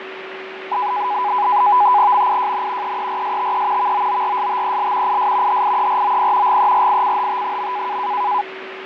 NAVTEX (SITOR-B), 100 baud, 170 Hz shift, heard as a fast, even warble, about 910 Hz centre, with radio static, fading and a steady whistle near 380 Hz. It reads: MIJN EERSTE VOORSTEL IS HIEROP GERICHT.